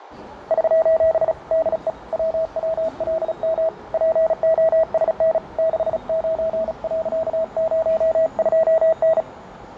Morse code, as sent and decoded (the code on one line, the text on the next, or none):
...---... / -.. . / .-- .-- .-.. -- / .--. --- ... -. / -.... ----. .-.-.- ----- ..--- -.
<SOS> DE WWLM POSN 69.02N